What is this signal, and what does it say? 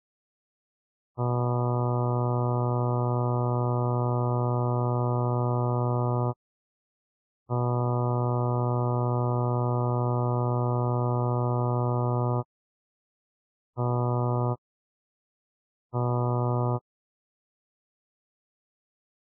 Ship horn signal, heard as a ship's horn, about 120 Hz. 2 long, 2 short. At sea: I intend to overtake on your port side.